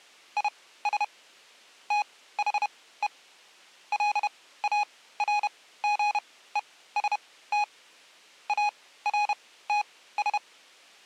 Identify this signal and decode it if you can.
Morse code, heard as electronic beeps, machine-sent, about 31 wpm, spaced as for 17 wpm, 830 Hz. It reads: IS THE LARGEST ARTS